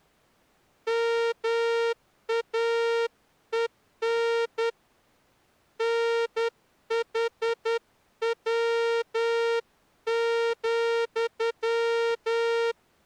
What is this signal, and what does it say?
Morse code, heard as a horn, hand-sent with a straight key, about 10 wpm. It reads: MAEN NHW,